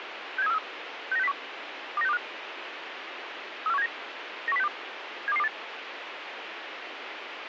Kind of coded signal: five-tone selective call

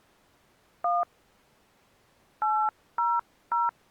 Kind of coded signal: DTMF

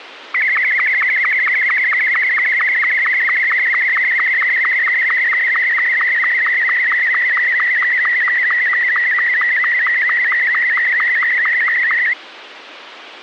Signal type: SSTV (slow-scan television)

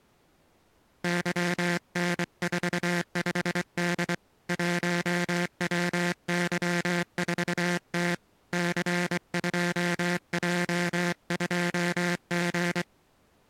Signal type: Morse code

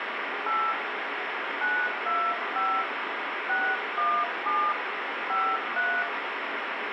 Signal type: DTMF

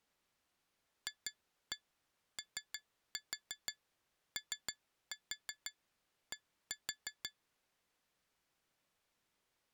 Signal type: tap code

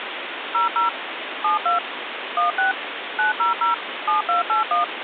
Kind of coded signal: DTMF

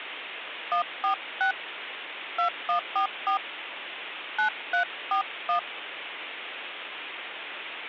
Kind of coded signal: DTMF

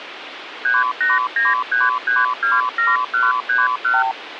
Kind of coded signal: multi-frequency trunk signalling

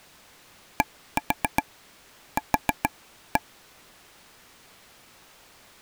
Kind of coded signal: tap code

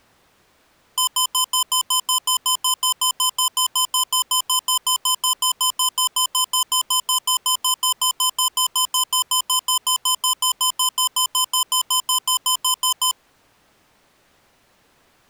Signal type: none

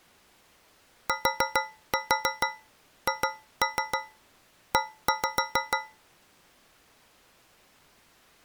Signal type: tap code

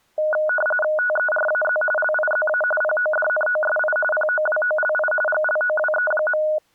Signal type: RTTY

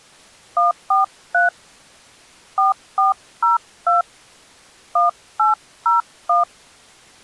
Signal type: DTMF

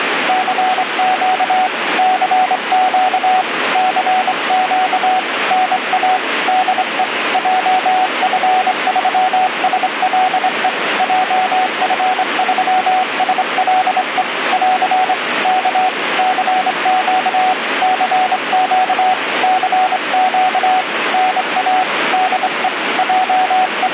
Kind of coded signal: Morse code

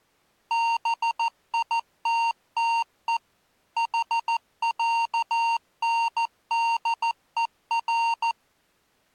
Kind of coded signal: Morse code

